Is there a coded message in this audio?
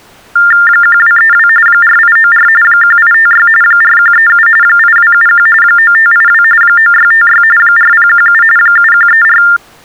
Yes: TTY/TDD text telephone tones (45.45 baud Baudot) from 0.4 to 9.6 s, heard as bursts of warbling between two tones, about 400 Hz shift, 1600 Hz centre. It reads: 1232 4894 1856 4137 8271 9582 9656 4017 7134